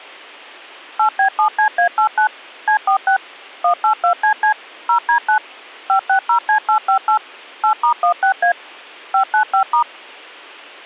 DTMF, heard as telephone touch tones, dialled by machine, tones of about 100 ms. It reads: 8B7CA89 C46 182CC 0D9 560C858 8*16A 595*